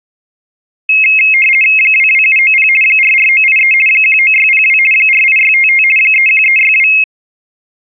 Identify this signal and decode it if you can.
RTTY (50 baud, 450 Hz shift), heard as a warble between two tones, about 2350 Hz centre. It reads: 22790 44983 19602 48655 31362